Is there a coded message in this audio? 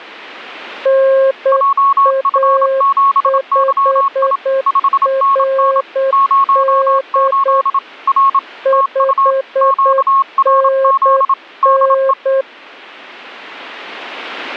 Yes: Morse code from 0.8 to 12.5 s, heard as two keyed tones. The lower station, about 8 wpm, 540 Hz: NA5RD 5NN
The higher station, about 27 wpm, 1100 Hz: JF7YI 5NN 08 R TU QRZ DE